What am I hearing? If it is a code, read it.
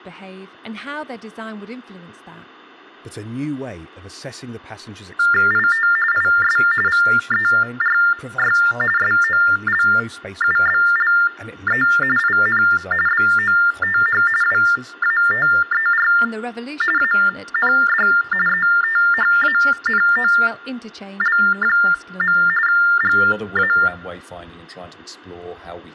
TTY/TDD text telephone tones (45.45 baud Baudot), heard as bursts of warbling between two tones, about 400 Hz shift, 1600 Hz centre, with speech in English. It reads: IT IS VERY SOLUBLE IN BOTH WATER AND ETHANOL. GA